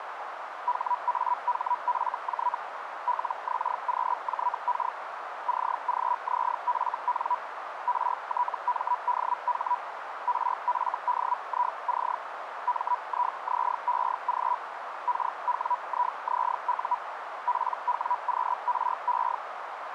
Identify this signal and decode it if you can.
Hellschreiber (Feld-Hell, 122.5 baud), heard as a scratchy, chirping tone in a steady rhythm, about 980 Hz, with radio static and a narrow filter. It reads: HAHFJ LXQJK CGZFN RTMDH RFDIC MIZEG KWIZU PWQRE